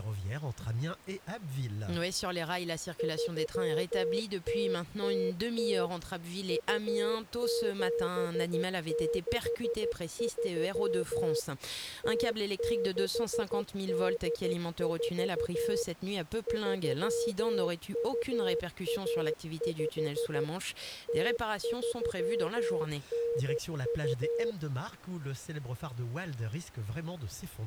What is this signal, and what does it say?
Morse code (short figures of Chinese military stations), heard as a keyed tone, machine-sent, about 13 wpm, 470 Hz. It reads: 3000 2763 0684 3215 0392